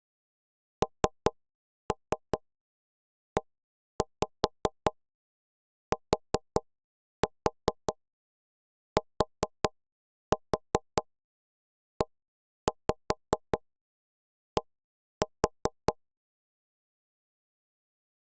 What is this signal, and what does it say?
Tap code, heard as knocks on wood, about 5 knocks a second. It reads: NETTED